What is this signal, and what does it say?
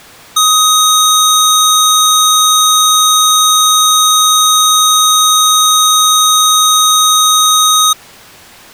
A steady tone. There is no code.